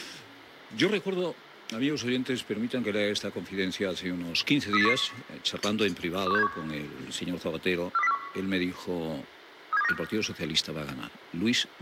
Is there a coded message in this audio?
Yes: five-tone selective call (EEA) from 4.7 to 9.9 s, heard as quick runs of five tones, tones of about 40 ms, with room echo. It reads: 30811 21671 42041 37295